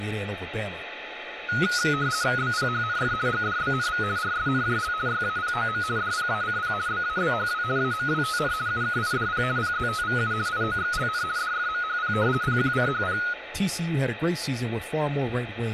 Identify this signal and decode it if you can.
RTTY (50 baud, 170 Hz shift), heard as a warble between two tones, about 1360 Hz centre, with radio static, a steady whistle near 860 Hz and speech in English. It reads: BPHNF GDBNV RSNJL YAPOM DPACP BABHW AMWTN UKIDP PZTVU IOXLN DFMHP PQCHP